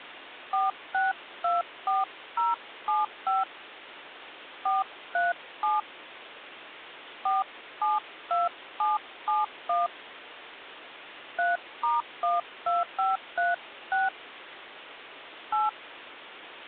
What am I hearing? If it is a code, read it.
DTMF, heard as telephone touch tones, dialled by hand, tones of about 170 ms, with phone line noise. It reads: 4624075 437 472771 3*12536 8